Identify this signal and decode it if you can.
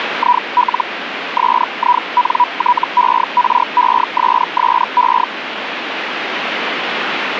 Hellschreiber (Feld-Hell, 122.5 baud), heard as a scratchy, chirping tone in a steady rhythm, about 980 Hz, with radio static. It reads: IL SINTERESSE